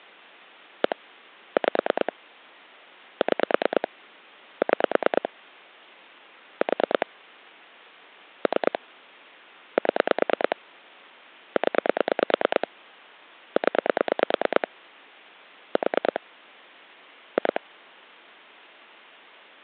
Pulse dialling, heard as clicks on a phone line, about 9 pulses a second. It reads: 1 5 6 6 4 3 7 0 0 4 2